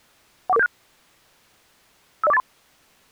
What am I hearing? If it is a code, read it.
Five-tone selective call (EIA), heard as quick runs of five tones, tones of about 30 ms. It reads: 14476 50483